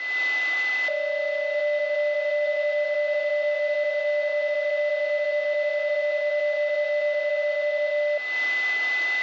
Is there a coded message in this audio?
Yes: PSK31 (31.25 baud) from 0.9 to 8.2 s, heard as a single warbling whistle, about 590 Hz, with a steady whistle near 2010 Hz.